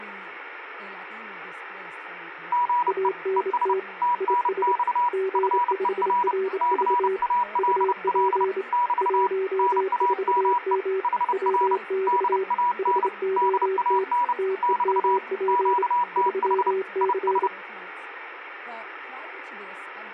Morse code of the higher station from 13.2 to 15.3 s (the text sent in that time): DAN <BT>